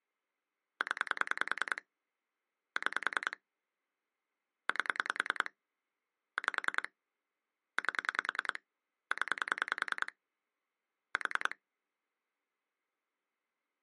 Pulse dialling, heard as clicks on a phone line, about 10 pulses a second. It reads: 0 6 8 5 8 0 4